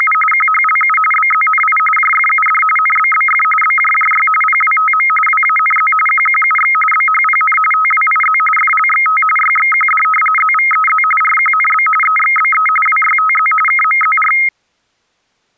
RTTY (45.45 baud, 850 Hz shift), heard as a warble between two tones, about 1700 Hz centre. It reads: … QHLU BZNI JFUD NBBF BJJY PWTM WANZ QQUX BHPN TWIZ FLXT YXQD ZVEZ RQNB EXBE WYTZ KMZR